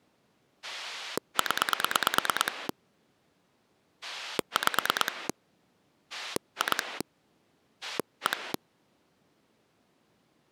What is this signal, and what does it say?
Pulse dialling, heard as a rotary dial, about 9 pulses a second. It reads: 0 5 2 1